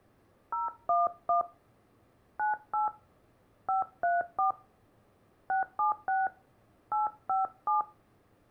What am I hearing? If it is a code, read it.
DTMF, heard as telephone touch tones, dialled by hand, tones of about 150 ms. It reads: 011 98 534 676 857